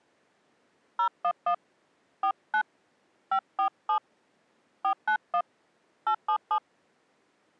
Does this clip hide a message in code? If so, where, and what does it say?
Yes: DTMF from 1.0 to 6.6 s, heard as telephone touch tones, dialled by hand, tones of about 80 ms. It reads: 011 49 547 491 877